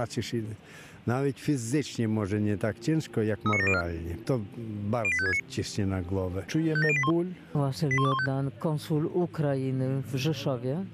Five-tone selective call (ZVEI), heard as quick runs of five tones, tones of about 70 ms, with a squelch burst at the end. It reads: 39704 08569 57081 81215